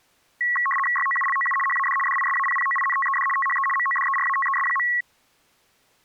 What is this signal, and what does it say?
RTTY (75 baud, 850 Hz shift), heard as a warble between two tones, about 1500 Hz centre. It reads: YOULOU HAD DISAPPOINTED THE MODERATES.